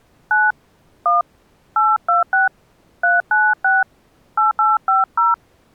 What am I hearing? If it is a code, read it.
DTMF, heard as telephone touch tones, dialled by hand, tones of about 190 ms. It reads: 9 1 826 396 8850